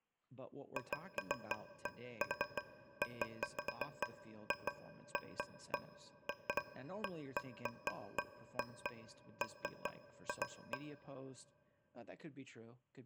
Irregular taps on a metal pipe, with room echo and speech in English. There is no code.